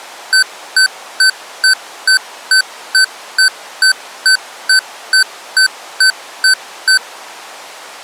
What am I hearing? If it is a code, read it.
Evenly repeated beeps. There is no code.